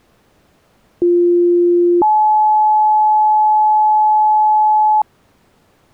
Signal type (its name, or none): two-tone page